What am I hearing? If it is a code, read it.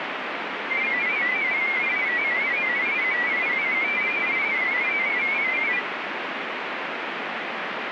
Multi-tone FSK (Olivia or MFSK type), about 500 Hz wide, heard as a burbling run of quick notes, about 31.25 baud, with radio static.